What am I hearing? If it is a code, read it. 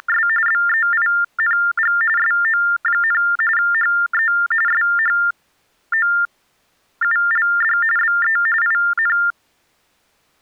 TTY/TDD text telephone tones (45.45 baud Baudot), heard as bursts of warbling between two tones, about 400 Hz shift, 1600 Hz centre. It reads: … BEING SO, HE SHOULD BE IN